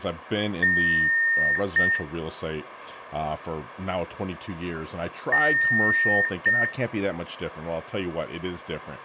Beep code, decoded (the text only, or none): 1 long, 1 short